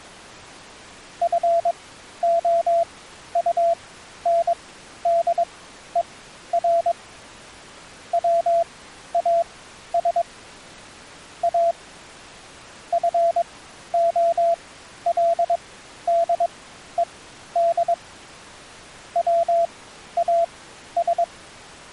Morse code, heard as a keyed tone, machine-sent, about 22 wpm, spaced as for 12 wpm, 680 Hz. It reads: FOUNDER WAS A FOLDED WAS